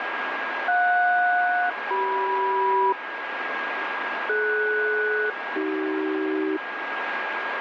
Aircraft SELCAL, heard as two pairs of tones, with radio static and a steady whistle near 1630 Hz. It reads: JS-CM DS-AC